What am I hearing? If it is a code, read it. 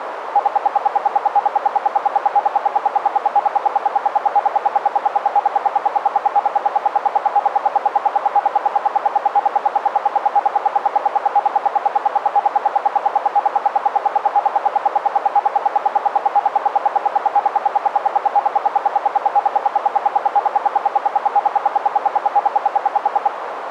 Radio time signal (RWM, Moscow), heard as ten pulses a second, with radio static and a narrow filter.